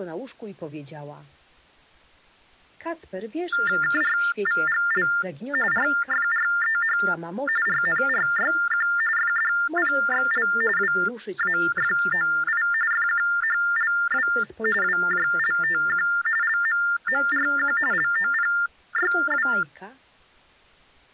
TTY/TDD text telephone tones (45.45 baud Baudot), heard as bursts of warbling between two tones, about 400 Hz shift, 1600 Hz centre. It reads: KRVGL RFREH RNRYQ FDPXL WAFOI FQHLW WJLTQ LMMRQ LOPYW